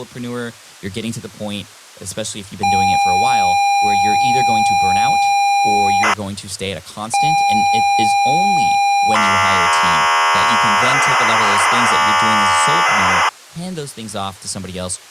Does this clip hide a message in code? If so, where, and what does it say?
Yes: ZX Spectrum tape loading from 2.6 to 13.3 s, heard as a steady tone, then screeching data, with speech in English.